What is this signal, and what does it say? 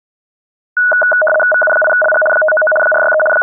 RTTY (75 baud, 850 Hz shift), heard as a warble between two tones, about 1050 Hz centre. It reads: VU8LG 599 463 …